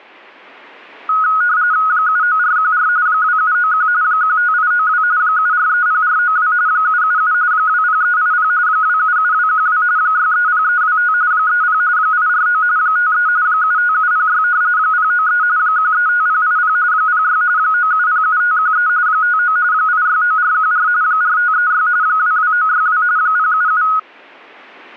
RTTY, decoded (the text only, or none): 79414 2791 15892 7430492 777 20380 277212 630325 30 849 53 75706 093 135080 06 9707513 59 869414 4536 22962 077